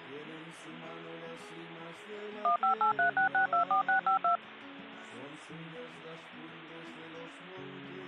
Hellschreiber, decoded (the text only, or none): none